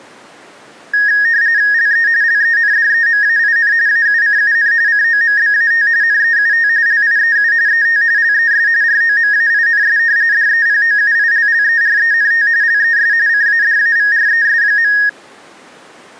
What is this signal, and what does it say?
RTTY (45.45 baud, 170 Hz shift), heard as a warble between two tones, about 1750 Hz centre. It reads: LE LENDEMAIN AUCUN COMBAT NEUT LIEU ET LES ROMAINS DEPOUILLERENT LES CADAVRES.